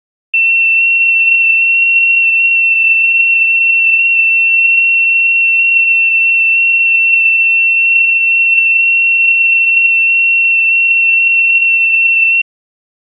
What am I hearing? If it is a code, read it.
FT8 (one signal), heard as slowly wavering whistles, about 6.25 baud.